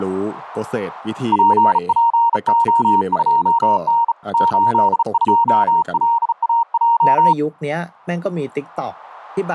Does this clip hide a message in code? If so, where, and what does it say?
Yes: Morse code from 1.3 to 7.4 s, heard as a keyed tone, hand-sent with a bug key, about 35 wpm, 930 Hz, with speech in Thai. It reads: PPO2N 82LAJ